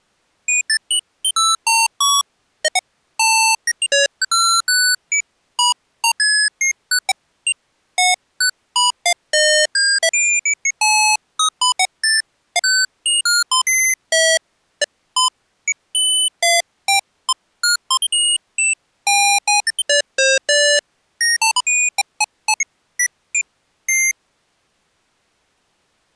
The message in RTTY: none

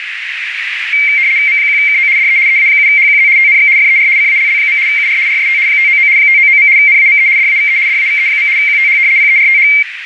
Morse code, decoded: none

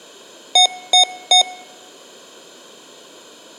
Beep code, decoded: 3 short

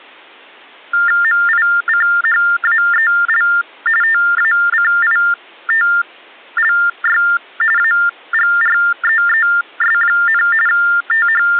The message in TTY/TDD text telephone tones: MICHAEL TACITLY AGREES, …

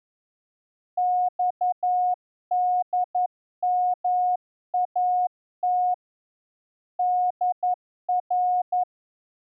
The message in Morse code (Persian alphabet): خدمات در

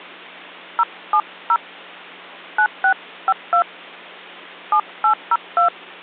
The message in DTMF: 070 9652 7802

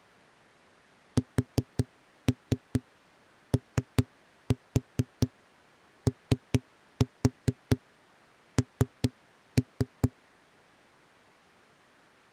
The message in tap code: SOON

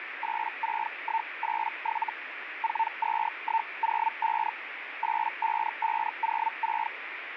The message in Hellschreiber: 86187 42105 85506

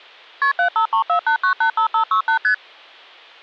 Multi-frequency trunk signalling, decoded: KP 75348985568 ST

